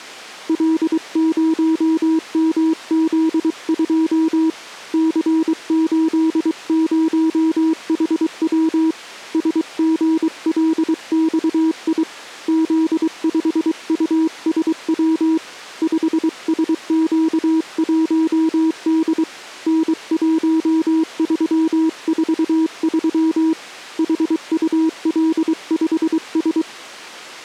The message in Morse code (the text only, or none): L0MZ2 C80HW SGLXI Z5USW 5SQ1D N1343 HUL5S